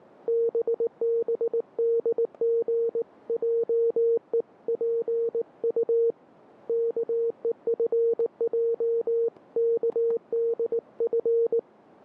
Morse code (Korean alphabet), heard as a keyed tone, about 19 wpm, 460 Hz, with static crashes. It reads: 뜻하지 않은